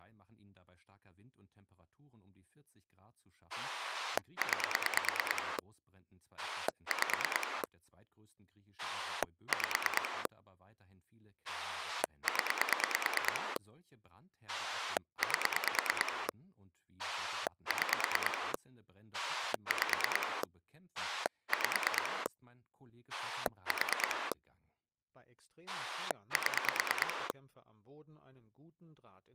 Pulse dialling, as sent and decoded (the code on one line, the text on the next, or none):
9 / 5 / 5 / 10 / 8 / 6 / 5 / 5 / 4 / 7
9 5 5 0 8 6 5 5 4 7